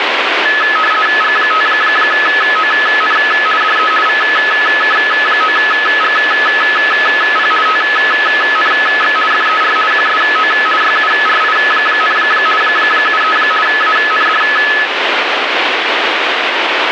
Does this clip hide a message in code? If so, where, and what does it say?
Yes: RTTY (50 baud, 450 Hz shift) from 0.5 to 14.9 s, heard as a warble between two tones, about 1500 Hz centre, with radio static. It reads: G5ON DE VK9GP TNX FER QSO YURI, 73 AND